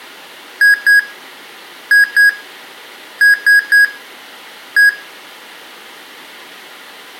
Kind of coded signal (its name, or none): beep code